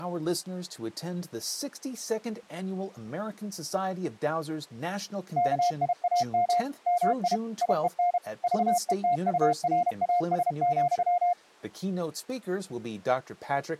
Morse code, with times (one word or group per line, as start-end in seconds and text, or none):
5.4-6.6 KIAM
6.9-7.4 MI
7.6-8.2 IEN
8.4-11.3 VETURAS,